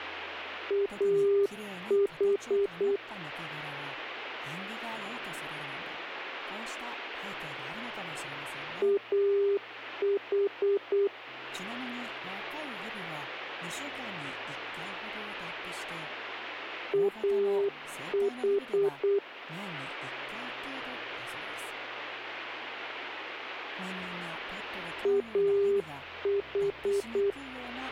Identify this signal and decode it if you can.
Morse code, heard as a keyed tone, machine-sent, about 8 wpm, 400 Hz, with radio static. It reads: AH AH AH AH